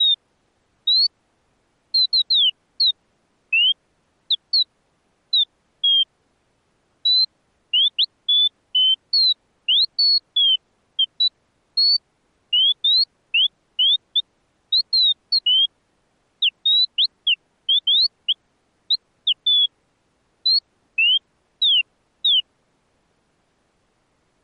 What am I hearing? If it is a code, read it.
Bird-like chirps. There is no code.